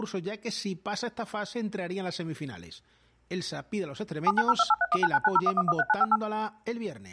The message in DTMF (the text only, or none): 790283199901113958